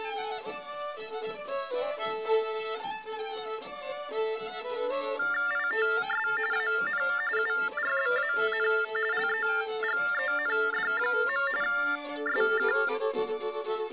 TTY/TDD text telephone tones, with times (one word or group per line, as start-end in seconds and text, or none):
5.5-6.3 ITS
6.5-7.0 AN
7.4-8.7 URBAN
9.1-11.5 LEGEND.
11.6-12.7 SK